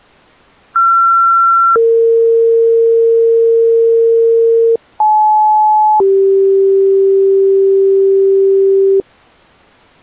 Two-tone page, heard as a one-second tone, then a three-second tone, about 1360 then 460 Hz, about 860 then 390 Hz.